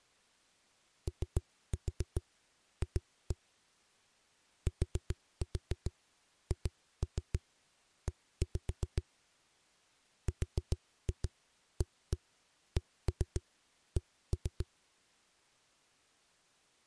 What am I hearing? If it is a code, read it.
Tap code, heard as knocks on a wall, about 7 knocks a second. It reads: OF THE RACK